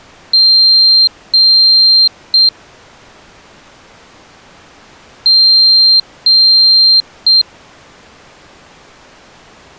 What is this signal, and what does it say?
Beep code, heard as a piezo beeper, played twice, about 4150 Hz. 2 long, 1 short.